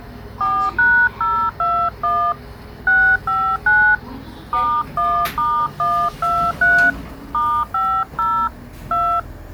DTMF, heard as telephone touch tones, dialled by hand, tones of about 290 ms, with the noise inside a lift. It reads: 4#021 659 *1*123 *50 2